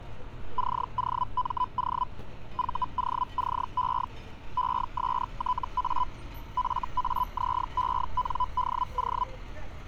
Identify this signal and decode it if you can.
Hellschreiber (Feld-Hell, 122.5 baud), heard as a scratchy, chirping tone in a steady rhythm, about 1000 Hz, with street noise. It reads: COMO VOCE ESTA FAZENDO